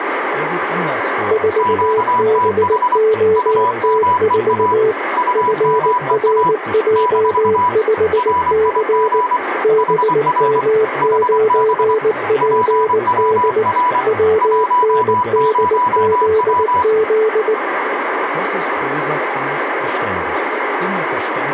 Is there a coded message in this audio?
Yes: Morse code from 1.2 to 17.6 s, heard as two keyed tones, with radio static and speech in German. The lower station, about 19 wpm, 440 Hz: 4BOT4 FRJ5C BM9PD WNDZZ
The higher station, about 24 wpm, 990 Hz: QTH UMEA UMEA - RIG HR HB PWR 10W